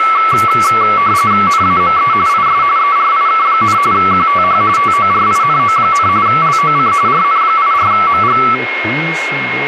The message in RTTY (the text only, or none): NAME IS ERIK, QTH TORINO, LOC RN84MG